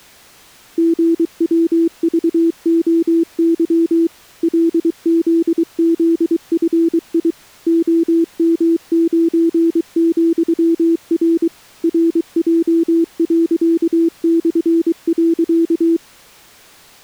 Morse code, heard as a keyed tone, machine-sent, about 23 wpm, 330 Hz. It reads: GWVOY LZZFI OM9,R RJ./.